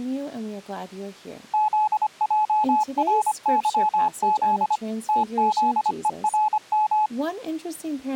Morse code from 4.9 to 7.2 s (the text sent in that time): TZERM